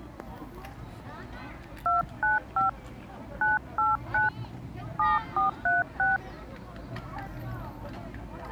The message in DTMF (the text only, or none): 295 989 7436